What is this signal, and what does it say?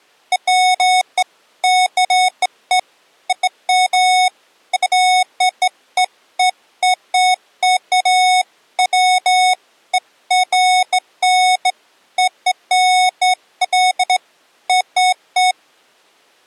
Beeps of irregular length. There is no code.